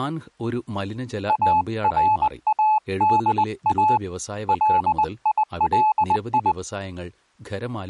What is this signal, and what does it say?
Morse code (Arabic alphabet), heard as a keyed tone, hand-sent with a paddle, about 20 wpm, 860 Hz, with speech in Malayalam. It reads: ارادا ليلي